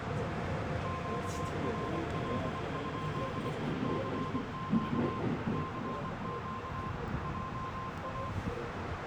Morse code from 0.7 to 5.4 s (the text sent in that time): QRL? CQ